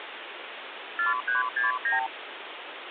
Multi-frequency trunk signalling (R2, with the far end's replies), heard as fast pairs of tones, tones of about 140 ms, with phone line noise. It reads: 4369